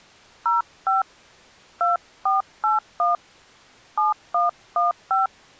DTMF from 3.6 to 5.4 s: 7115

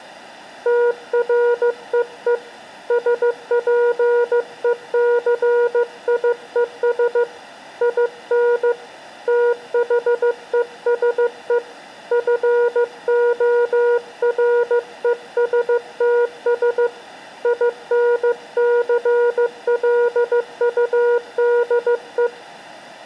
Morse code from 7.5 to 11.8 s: IN THESE

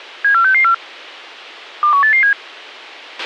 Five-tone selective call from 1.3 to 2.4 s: 21887

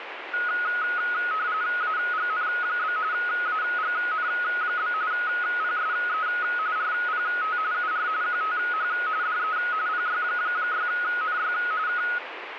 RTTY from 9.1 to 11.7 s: DE PY6NY

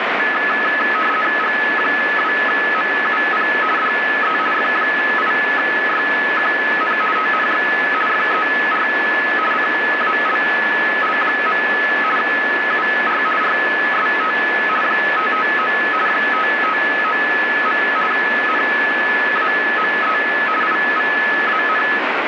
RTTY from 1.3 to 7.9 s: G2MUP DE F8YQN TNX

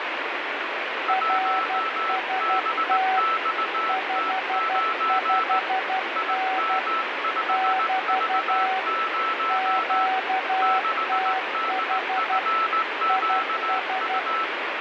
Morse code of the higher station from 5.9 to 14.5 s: IM5V0 6DFQU

